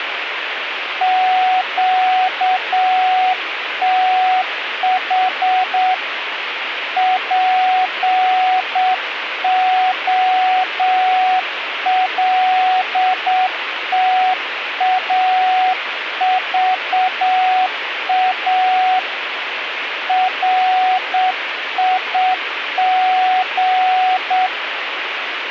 Morse code, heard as a keyed tone, hand-sent with a straight key, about 7 wpm, 740 Hz, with radio static. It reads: QTH POLTAVA RIG